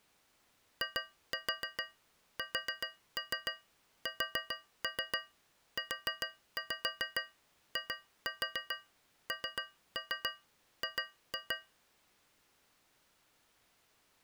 Tap code, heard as taps on a metal pipe, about 7 knocks a second. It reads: ISSUING